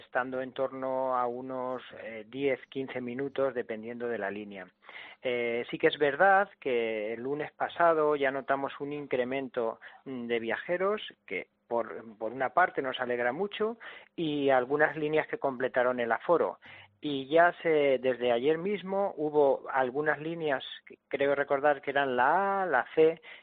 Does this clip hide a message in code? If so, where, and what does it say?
No.